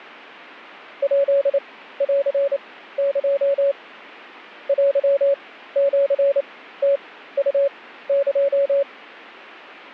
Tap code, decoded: none

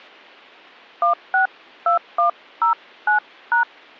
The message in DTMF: 162109#

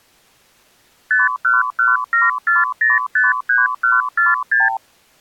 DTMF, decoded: none

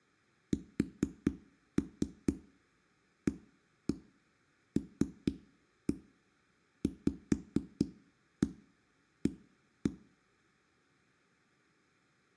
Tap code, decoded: SALVA

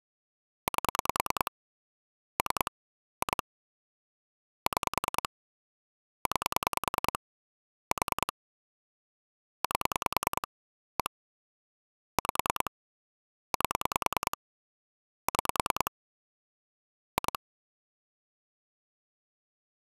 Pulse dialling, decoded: 8 3 2 6 9 4 8 1 5 8 6 2

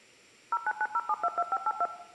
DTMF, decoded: 0990722582

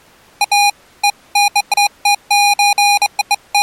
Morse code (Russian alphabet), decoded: none

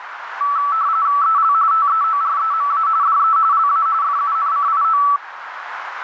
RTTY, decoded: EL TEOREMA DE LA FUNCIO

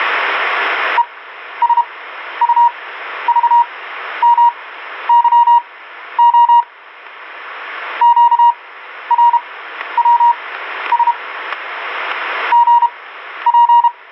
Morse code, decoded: ESUVMYO QRWS GP

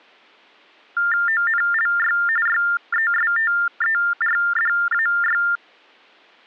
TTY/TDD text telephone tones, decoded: ONLY YESTERDAY

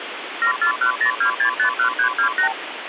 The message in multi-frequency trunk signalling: 74102651328

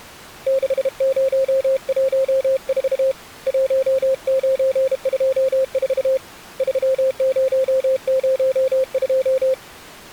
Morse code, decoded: 6014 1924 3002

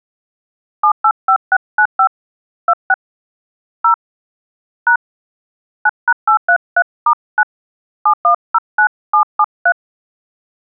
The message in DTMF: 785695 26 0 # 9#833*9 7109773

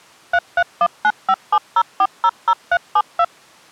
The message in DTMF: 3319570400372

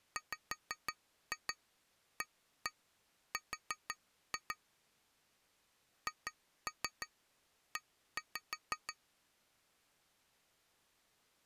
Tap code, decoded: WAR HE

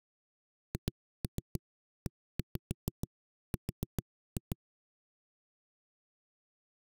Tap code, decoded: HER

